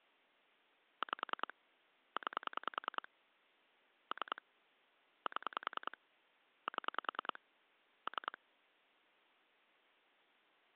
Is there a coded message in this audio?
Yes: pulse dialling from 1.0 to 8.4 s, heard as clicks on a phone line, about 10 pulses a second. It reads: 5 9 3 7 7 3